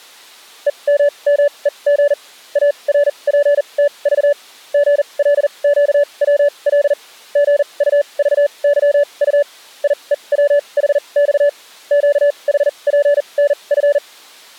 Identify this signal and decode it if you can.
Morse code, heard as a keyed tone, machine-sent, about 40 wpm, spaced as for 29 wpm, 580 Hz. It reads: EMMEG ARPTV GLQWL GUVYU IEWHX QHPNF